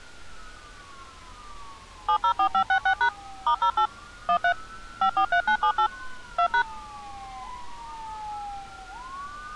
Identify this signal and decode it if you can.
DTMF, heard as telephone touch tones, dialled by machine, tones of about 80 ms, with street noise. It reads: 704566# *08 13 543978 2#